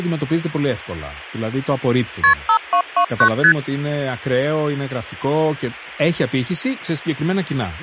Multi-frequency trunk signalling (R1, as on North American trunks), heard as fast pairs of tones, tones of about 80 ms, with speech in Greek. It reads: KP 5229 ST